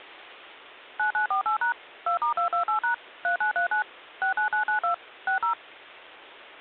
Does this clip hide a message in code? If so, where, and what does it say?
Yes: DTMF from 1.0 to 5.5 s, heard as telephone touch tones, dialled by machine, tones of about 110 ms. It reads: 9948# 2*228# 3939 69992 60